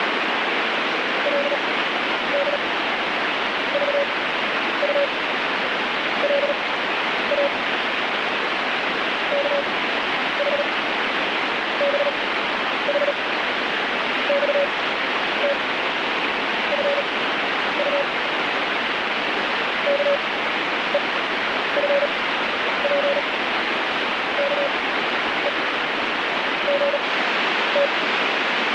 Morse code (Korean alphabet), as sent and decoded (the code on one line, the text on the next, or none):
.-.. -.. ...- ..- .-.. .- / -.- .... -... .... -..- - ..-. ..- / -.- . ..-. .--. -.- . --. -
그리고 우두커니 앉아서